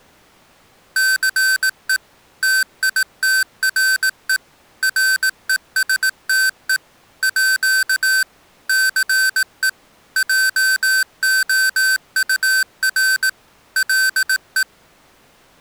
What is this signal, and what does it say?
Morse code (with French letters), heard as electronic beeps, machine-sent, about 18 wpm, 1550 Hz. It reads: CE TITRE RESTE À CE JOUR LE